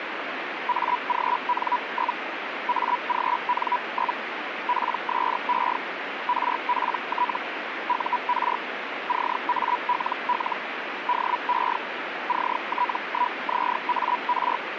Hellschreiber (Feld-Hell, 122.5 baud), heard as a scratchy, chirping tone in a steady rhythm, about 980 Hz, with radio static. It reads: AGN? AGN? PSE RPT UR CALL DE CT1ZAR